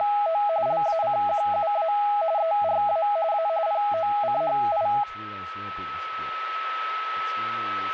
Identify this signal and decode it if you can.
RTTY (45.45 baud, 170 Hz shift), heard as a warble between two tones, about 740 Hz centre, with a steady whistle near 1300 Hz and speech in English. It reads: … LACQUA ERA A POCHI